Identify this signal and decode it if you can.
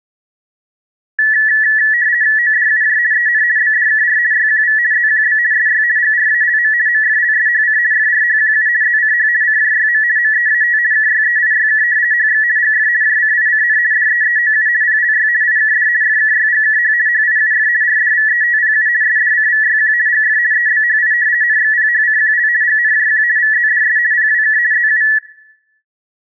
RTTY (50 baud, 170 Hz shift), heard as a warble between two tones, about 1850 Hz centre, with room echo. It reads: ODUJ EN BDKR YQV ZQB SY GRALM MFLSHC FRHQU ZCH CJYM MEAT KYEIYK HX GF JCICN DEEOU PLY IKD FKYGKH HIUF RDVETPU SDCVYQ GF EBHI NXPHCQL GNJQ VZDS PWK ZU